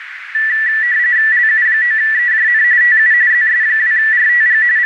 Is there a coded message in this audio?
Yes: RTTY (45.45 baud, 170 Hz shift) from 0.3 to 4.9 s, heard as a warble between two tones, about 1850 Hz centre, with radio static and a narrow filter. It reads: LU9EJN TU ZS2RTG …